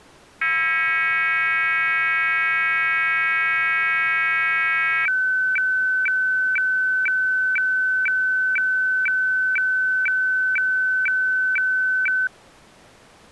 Weather fax (radiofax), 120 lines a minute, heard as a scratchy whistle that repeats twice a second.